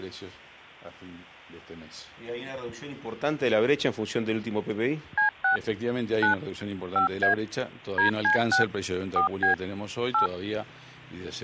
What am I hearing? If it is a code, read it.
DTMF, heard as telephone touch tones, dialled by machine, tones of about 120 ms, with hum. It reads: C6 9 5A DC6 4B 8